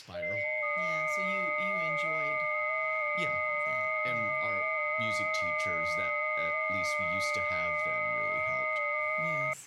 FT8 (several signals at once), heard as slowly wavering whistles, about 6.25 baud, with speech in English.